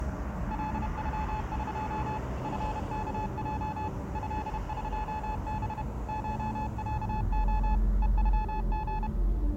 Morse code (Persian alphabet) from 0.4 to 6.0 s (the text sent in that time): لغق فکج ضقب